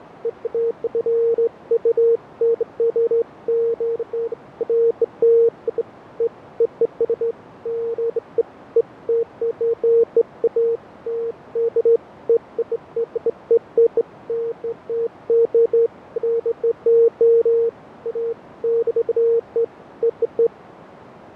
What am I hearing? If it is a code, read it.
Beeps of irregular length, with radio static and fading. There is no code.